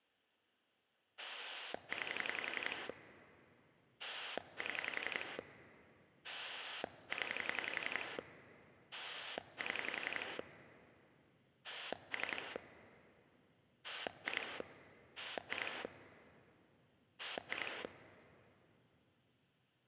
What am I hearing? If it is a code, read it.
Pulse dialling, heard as a rotary dial, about 11 pulses a second, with room echo. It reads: 9 7 0 7 3 2 2 2